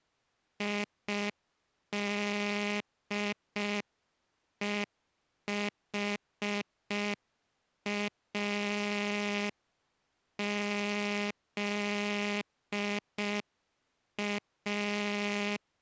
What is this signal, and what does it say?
Morse code, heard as a buzzer, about 5 wpm. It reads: IDEHAZA